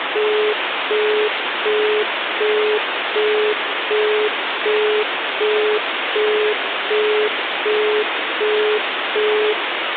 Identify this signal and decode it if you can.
Telephone call progress tone (as in the UK, Australia and similar networks), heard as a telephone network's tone, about 420 Hz, 0.375 s on and 0.375 s off, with phone line noise. Busy tone.